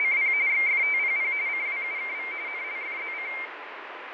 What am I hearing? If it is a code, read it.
RTTY (45.45 baud, 170 Hz shift), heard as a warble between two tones, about 2200 Hz centre, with radio static and fading. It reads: … XFTPP CWUKV NLFZC